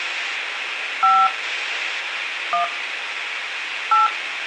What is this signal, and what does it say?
DTMF, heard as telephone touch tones, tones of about 190 ms, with radio hiss. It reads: 5 1 8